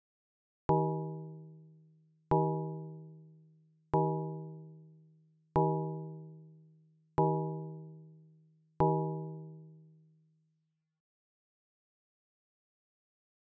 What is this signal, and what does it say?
Clock strike, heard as a bell. 6. Six o'clock.